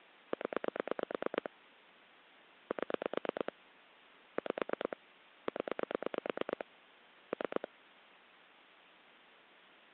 Pulse dialling, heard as clicks on a phone line, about 9 pulses a second. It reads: 0 7 5 0 3